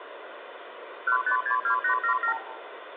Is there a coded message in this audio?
Yes: multi-frequency trunk signalling (R2, with the far end's replies) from 1.1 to 2.4 s, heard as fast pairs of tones, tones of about 100 ms, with phone line noise and room echo. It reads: 1562877